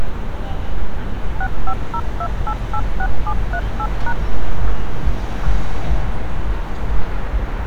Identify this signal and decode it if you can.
DTMF, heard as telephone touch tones, dialled by machine, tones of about 60 ms, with street noise. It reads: 6502886738#